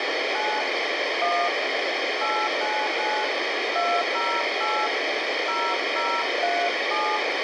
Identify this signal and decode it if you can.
DTMF, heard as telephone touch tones, dialled by hand, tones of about 260 ms, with radio hiss. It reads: 9 1 899 208 0037